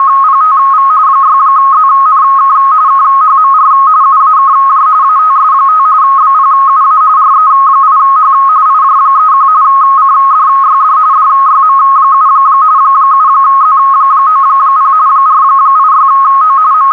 RTTY (45.45 baud, 170 Hz shift), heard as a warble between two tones, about 1180 Hz centre, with radio static. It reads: … 6ZNK KHMR UAKJ ATS5 BPUA RE8H IJ31 CDYD DYM7 7Z90 486O …